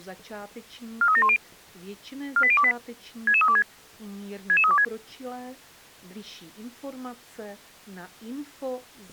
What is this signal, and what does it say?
Five-tone selective call (ZVEI), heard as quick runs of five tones, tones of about 70 ms. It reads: 43710 48028 66326 66326